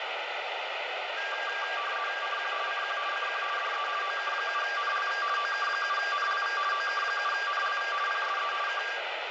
RTTY (50 baud, 450 Hz shift), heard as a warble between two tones, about 1390 Hz centre, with radio static and room echo. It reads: CQ CQ CQ DE OK7NLV OK7NLV OK7NLV PSE K